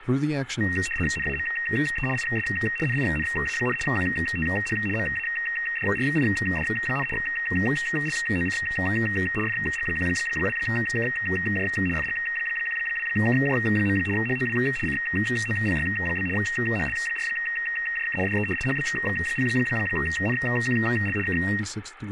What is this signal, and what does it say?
RTTY (75 baud, 850 Hz shift), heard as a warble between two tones, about 2300 Hz centre, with radio static, static crashes and speech in English. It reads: NAME IS NINA, QTH MADRID, LOC FG12KJ FG12KJ. HOW COPY? HL4JK DE HB0NQL K